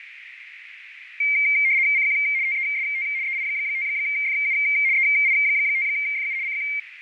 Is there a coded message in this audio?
Yes: RTTY (75 baud, 170 Hz shift) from 1.2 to 6.8 s, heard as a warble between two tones, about 2200 Hz centre, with radio static, fading and a narrow filter. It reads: CQ TEST EI5FU EI5FU CQ